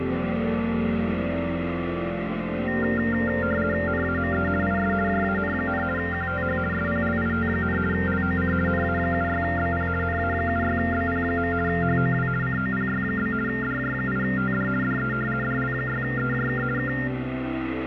RTTY (50 baud, 450 Hz shift), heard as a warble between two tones, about 1600 Hz centre, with radio static. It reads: NAME IS JAN, QTH SPLIT, LOC NA76BP NA76BP. HOW COPY? DJ8TD DE DL6EJK K